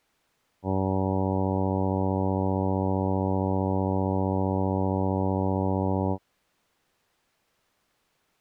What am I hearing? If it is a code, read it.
Ship horn signal, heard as a ship's horn, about 100 Hz. 1 long. At sea: a vessel nearing a blind bend, or under power and making way in fog.